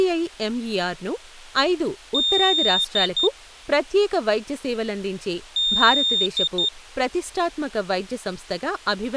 Beep code, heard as a piezo beeper, played twice, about 3650 Hz, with speech in Telugu. 1 long, 2 short. In Award, IBM and AMI BIOS tables: video adapter failure.